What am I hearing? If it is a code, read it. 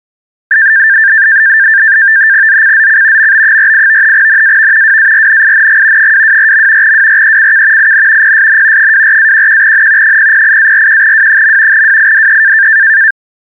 NAVTEX (SITOR-B), 100 baud, 170 Hz shift, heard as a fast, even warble, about 1700 Hz centre. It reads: ZCZC MB48 NAV WARNING 224. WRECK IN PSN 24-11N 008-41W. WIDE